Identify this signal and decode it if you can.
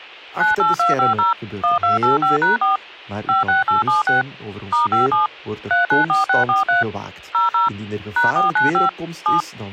DTMF, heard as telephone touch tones, dialled by machine, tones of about 140 ms, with speech in Dutch. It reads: 98250 1285#4 56876 *57 394643 00 #495 7